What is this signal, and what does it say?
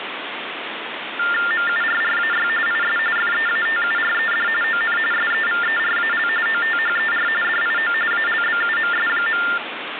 TTY/TDD text telephone tones (45.45 baud Baudot), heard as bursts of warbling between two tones, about 400 Hz shift, 1600 Hz centre, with phone line noise. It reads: MURRAY IS FEATURED ON SEVERAL OTHER DIO ALBUMS.